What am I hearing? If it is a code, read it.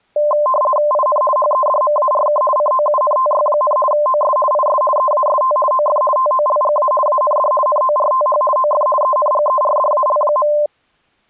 RTTY (50 baud, 450 Hz shift), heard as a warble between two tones, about 820 Hz centre. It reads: IN HEDMARK COUNTY, OS IS EAST OF TOLGA AND NORTH OF ENGERDAL.